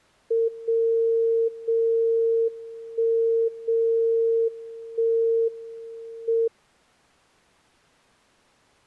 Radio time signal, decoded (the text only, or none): 0 0 1 0 1 M